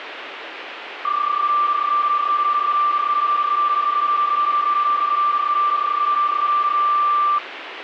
PSK31 (31.25 baud), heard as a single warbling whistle, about 1180 Hz, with radio static.